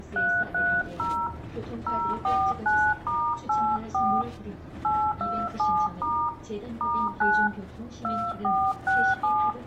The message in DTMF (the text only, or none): 330 049*84 827* *9 2467